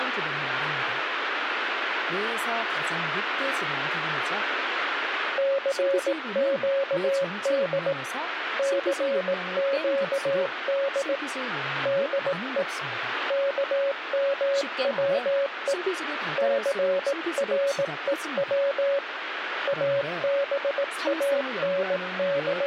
Morse code, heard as a keyed tone, hand-sent with a paddle, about 18 wpm, 560 Hz, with radio static and speech in Korean. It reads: CQD CQD DE KMWE CREW …